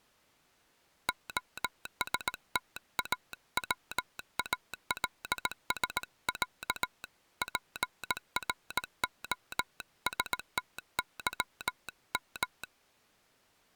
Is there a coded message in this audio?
Yes: Morse code (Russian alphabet) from 1.0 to 12.7 s, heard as a telegraph sounder, hand-sent with a paddle, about 18 wpm. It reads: ОСТАВАЛСЯ ПРОСТЫМ